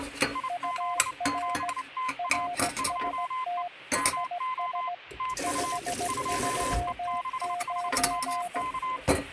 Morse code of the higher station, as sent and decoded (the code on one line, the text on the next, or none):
.. --.. --... - .- / ..--- . / -- --- / - ..- / ..--- . -.... .... -- -.-
IZ7TA 2E MO TU 2E6HMK